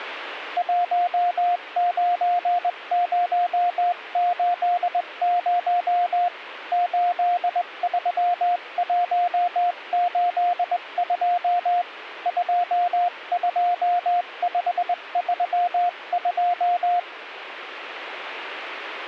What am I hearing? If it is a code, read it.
Morse code, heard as a keyed tone, hand-sent with a straight key, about 20 wpm, 710 Hz. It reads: 19080 83182 22532